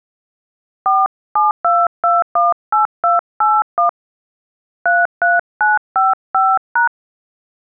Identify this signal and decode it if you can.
DTMF, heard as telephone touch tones, dialled by hand, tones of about 160 ms. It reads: 472218281 33955#